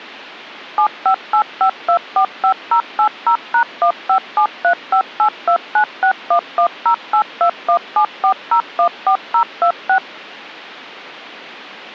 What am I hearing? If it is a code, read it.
DTMF, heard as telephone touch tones, dialled by machine, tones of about 90 ms. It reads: 7585245080#15735829611082174014026